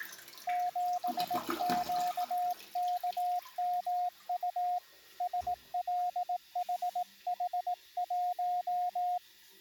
Morse code, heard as a keyed tone, hand-sent with a paddle, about 18 wpm, 720 Hz, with the noise of a restroom. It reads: 7QKMU SLHH1